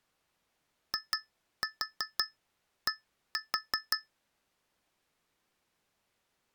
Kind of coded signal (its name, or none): tap code